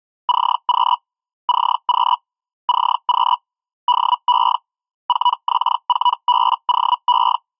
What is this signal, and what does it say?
Hellschreiber (Feld-Hell, 122.5 baud), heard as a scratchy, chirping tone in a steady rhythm, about 980 Hz. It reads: CQ CQ CQ DE 4X4BOE